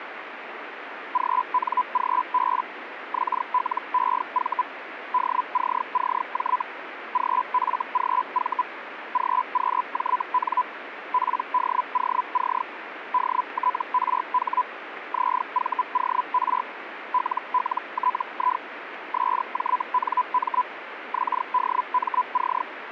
Hellschreiber (Feld-Hell, 122.5 baud), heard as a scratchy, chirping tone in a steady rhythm, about 1000 Hz, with radio static. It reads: GNGB XLEV DCCJ GFGV GQJN PDOC DTRH ZVOR LLTI SJNM XDMC